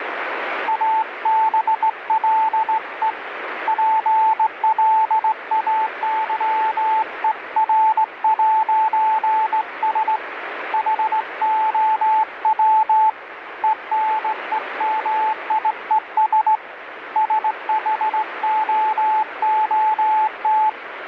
Morse code, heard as a keyed tone, hand-sent with a straight key, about 18 wpm, 870 Hz, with radio static. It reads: ABLE PLAYER'S HOW ENEMIES SHOOT